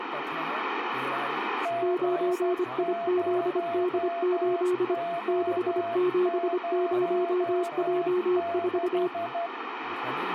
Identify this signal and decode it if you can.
Morse code, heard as two keyed tones, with radio static, room echo and speech in Sanskrit. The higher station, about 12 wpm, 680 Hz: G0O06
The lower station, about 25 wpm, 360 Hz: 9IZD8 670J4